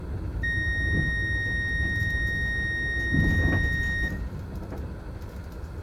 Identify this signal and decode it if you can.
A steady tone, with room echo and the noise inside a bus. There is no code.